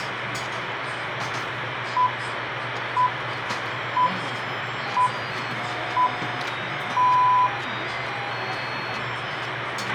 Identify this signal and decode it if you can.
Radio time signal (six pips, as the Greenwich Time Signal), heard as pips, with radio hiss, a squelch burst at the end, room echo and the noise of a restaurant.